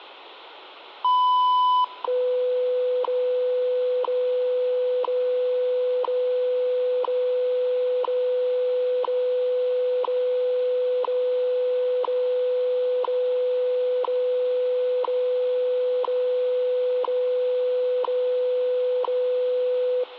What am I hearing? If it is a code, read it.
Radio time signal (WWV, Colorado), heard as ticks, one a second, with radio static.